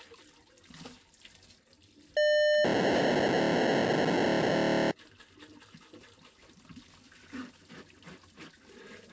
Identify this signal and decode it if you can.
POCSAG pager data (1200 baud), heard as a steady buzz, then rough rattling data, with kitchen noise.